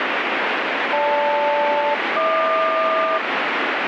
Aircraft SELCAL, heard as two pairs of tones, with radio static. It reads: GL-HQ